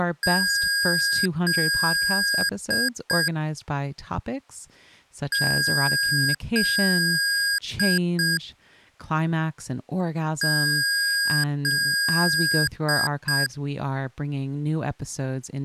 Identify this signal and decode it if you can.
Beep code, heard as beeps from a small speaker, played three times, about 1650 Hz, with speech in English. 2 long, 2 short.